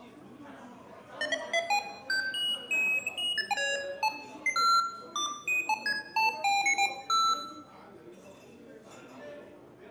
Electronic bleeps of random pitch and length, with room echo and the noise of a crowd indoors. There is no code.